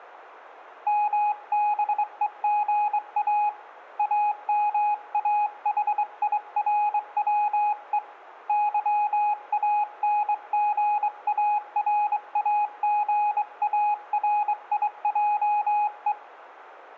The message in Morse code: MBEGA AMAHIRWE YANGARAGARIJE

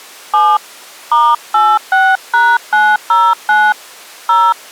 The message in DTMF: 7 *86#909 0

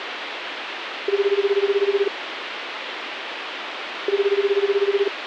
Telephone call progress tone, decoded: ringback tone

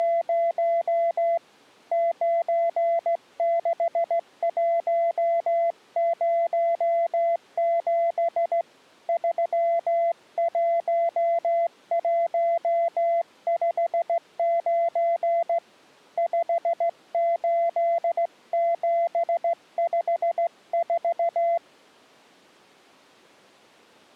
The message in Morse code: … 96107 31159 58754

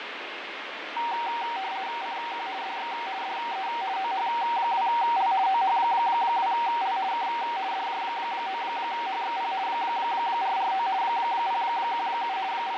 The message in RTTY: CQ DX DE OH2L OH2L K DJ9HXP 449 017 …

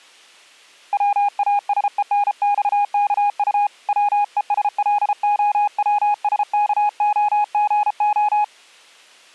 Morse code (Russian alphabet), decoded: ВАСЕНЬКУ ВЕСЛОВСКОГО

